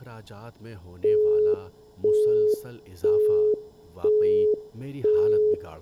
Telephone call progress tone (single-tone plan, as in Europe, Japan and elsewhere), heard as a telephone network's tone, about 420 Hz, 0.5 s on and 0.5 s off, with room echo and speech in Urdu. Busy tone.